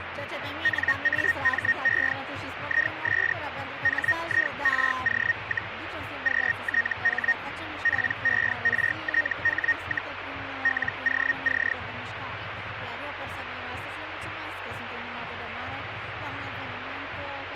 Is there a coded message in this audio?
Yes: Hellschreiber (Feld-Hell, 122.5 baud) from 0.6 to 11.7 s, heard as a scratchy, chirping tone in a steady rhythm, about 1850 Hz, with radio static. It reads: NAME IS HIRO, QTH PERTH, LOC